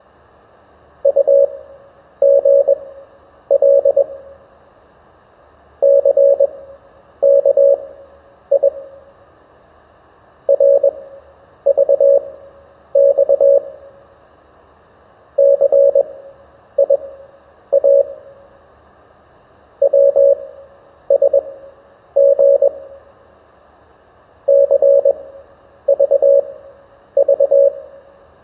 Morse code, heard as a keyed tone, machine-sent, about 21 wpm, spaced as for 9 wpm, 560 Hz, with room echo. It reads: UGL CKI RVX CIA WSG CVV